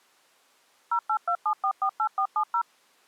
DTMF, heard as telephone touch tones, dialled by machine, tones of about 80 ms. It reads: 0827448470